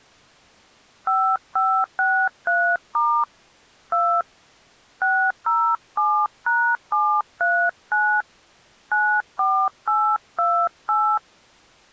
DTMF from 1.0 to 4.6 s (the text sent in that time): 5563* 2